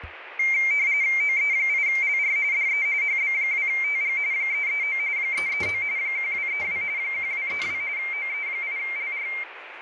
RTTY (45.45 baud, 170 Hz shift), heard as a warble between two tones, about 2200 Hz centre, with radio static, fading and kitchen noise. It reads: OE8LR DE HB2TG 339 339 1232 1232 OE8LR